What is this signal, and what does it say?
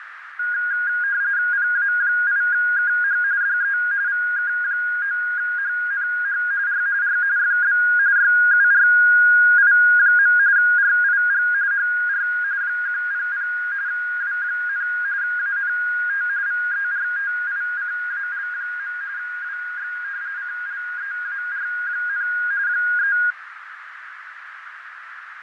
RTTY (45.45 baud, 170 Hz shift), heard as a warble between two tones, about 1550 Hz centre, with radio static, fading and a narrow filter. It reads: PA8KH DE VK9HNH R R FB YURI. RIG HR 100 W, ANT VERTICAL. WX CLEAR, 3